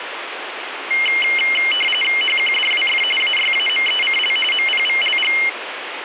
RTTY (45.45 baud, 850 Hz shift), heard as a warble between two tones, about 2550 Hz centre, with radio static. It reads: HQDWF AYAMECL MPVLG